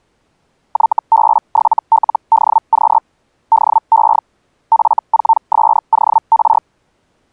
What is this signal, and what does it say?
Hellschreiber (Feld-Hell, 122.5 baud), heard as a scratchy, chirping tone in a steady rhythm, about 900 Hz. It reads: YB7LDQ DE F4SOR